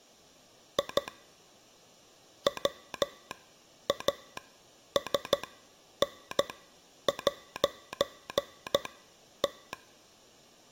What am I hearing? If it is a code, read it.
Morse code, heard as a telegraph sounder, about 13 wpm, spaced as for 9 wpm. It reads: I WASN'T